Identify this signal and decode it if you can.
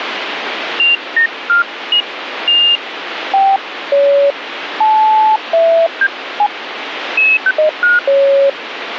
Electronic bleeps of random pitch and length, with radio static. There is no code.